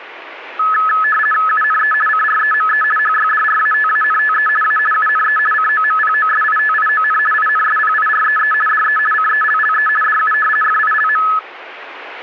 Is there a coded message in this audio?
Yes: RTTY (50 baud, 450 Hz shift) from 0.6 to 11.4 s, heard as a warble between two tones, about 1500 Hz centre. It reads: UNE CREME HYDRATANTE A UNE COMPOSITION INSPIREE DE CELLE DU FILM